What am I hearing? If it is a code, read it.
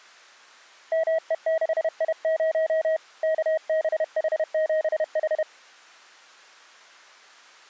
Morse code, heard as a keyed tone, hand-sent with a paddle, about 31 wpm, 640 Hz. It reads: ME6I0 KBH7H